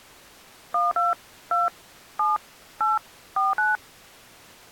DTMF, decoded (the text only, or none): 12 2 7 8 49